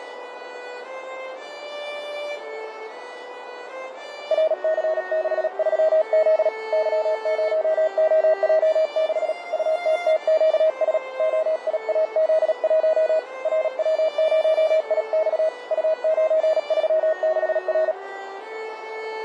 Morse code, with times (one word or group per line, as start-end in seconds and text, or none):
4.3-6.5 RC63Z
6.7-9.3 Y0OJ6
9.5-11.0 UTTQS
11.2-13.2 OIAZ1
13.5-15.5 RW0IX
15.7-17.9 U936R